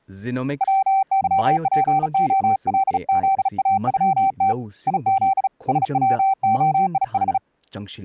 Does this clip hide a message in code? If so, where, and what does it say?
Yes: Morse code (Russian alphabet) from 0.6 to 7.4 s, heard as a keyed tone, hand-sent with a bug key, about 36 wpm, 780 Hz, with speech in Manipuri. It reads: ВЫПОЛЗАЮТ ИЗ СВОИХ